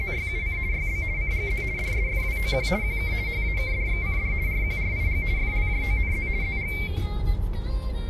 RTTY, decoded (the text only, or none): … YB CGZ DSFWOQ QK HAKDXCD RQRIG FLJONZ ZG